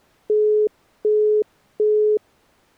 Telephone call progress tone (as in the UK, Australia and similar networks), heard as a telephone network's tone, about 420 Hz, 0.375 s on and 0.375 s off. Busy tone.